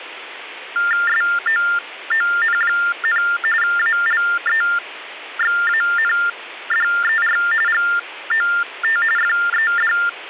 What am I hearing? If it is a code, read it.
TTY/TDD text telephone tones (45.45 baud Baudot), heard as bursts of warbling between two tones, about 400 Hz shift, 1600 Hz centre, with phone line noise. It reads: SOON, ALEXANDER GOT FED